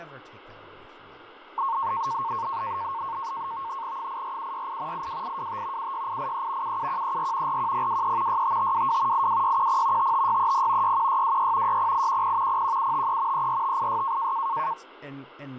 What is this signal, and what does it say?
NAVTEX (SITOR-B), 100 baud, 170 Hz shift, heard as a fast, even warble, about 1000 Hz centre, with radio static, fading and speech in English. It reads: 84768 82825 76883 77134 41023 65522 82610 55630 61626 60810 01753 34586